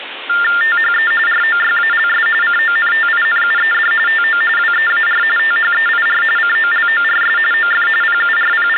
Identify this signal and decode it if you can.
TTY/TDD text telephone tones (45.45 baud Baudot), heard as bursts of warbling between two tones, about 400 Hz shift, 1600 Hz centre, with phone line noise. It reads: THE ROYALS CONTINUED TO WEAR THEIR COLORS OF …